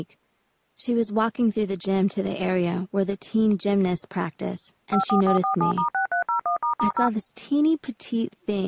DTMF, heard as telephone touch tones, dialled by machine, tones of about 110 ms. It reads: 54447*6301**0